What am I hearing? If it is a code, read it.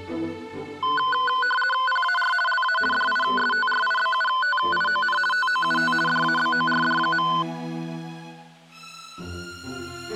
RTTY (50 baud, 450 Hz shift), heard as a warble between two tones, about 1260 Hz centre. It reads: PAR LA DISTRIBUTION TOUT DABORD.